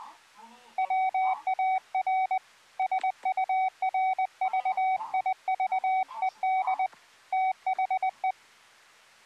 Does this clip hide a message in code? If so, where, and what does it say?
Yes: Morse code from 0.7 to 8.4 s, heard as a keyed tone, hand-sent with a paddle, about 20 wpm, 760 Hz, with the noise inside a lift. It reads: WAR SURVIVED THE